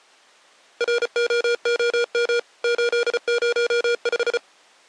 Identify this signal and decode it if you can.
Morse code, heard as electronic beeps, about 34 wpm, 480 Hz. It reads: ROOM 805